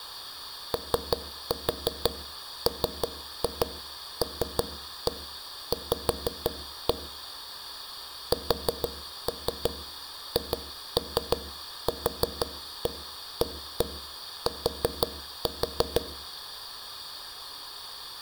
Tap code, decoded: OMLV SHQAT

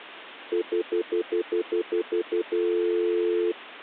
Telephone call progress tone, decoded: stutter dial tone

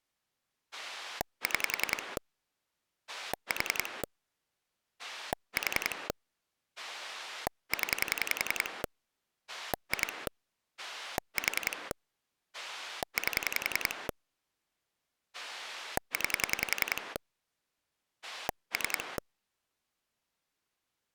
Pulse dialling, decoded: 6 4 4 0 2 4 8 9 3

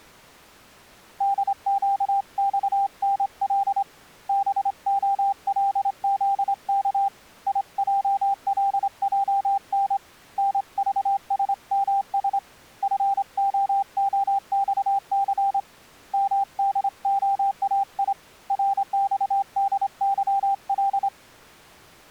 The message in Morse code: DQXNL BOLZK IJLJN NVSMS FOOXC MDOAI RXDYL

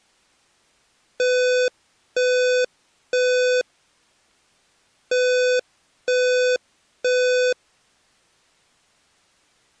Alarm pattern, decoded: temporal three

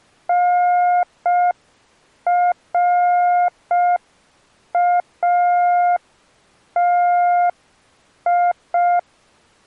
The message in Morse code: NRATI

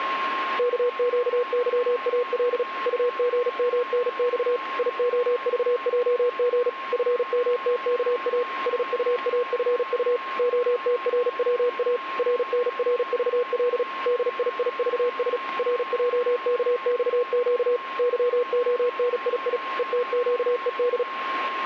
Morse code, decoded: KQYAL UGMNX IOVJG FMTKA SUAFU OTRWA RNRVL DIIVS RJKXQ YONII ETQED

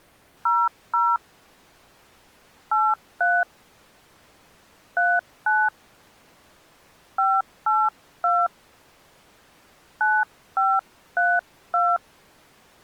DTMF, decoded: 00 83 39 582 9532

